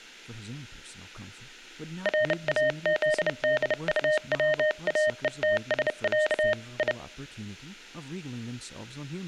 Morse code (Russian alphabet), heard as a keyed tone, hand-sent with a bug key, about 30 wpm, 610 Hz, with room echo and speech in English. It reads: РАЗДУВАЕТСЯ И